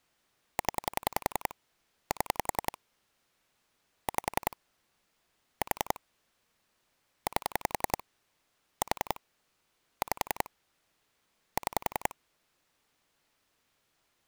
Pulse dialling, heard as clicks on a phone line, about 10 pulses a second. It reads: 0 7 5 4 8 4 5 6